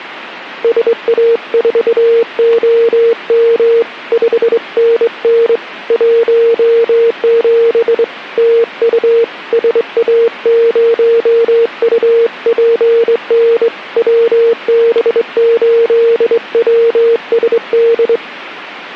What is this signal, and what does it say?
Morse code, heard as a keyed tone, hand-sent with a straight key, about 23 wpm, 460 Hz. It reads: SA4OM 5NN 17 TU SA0UPN WB8WSD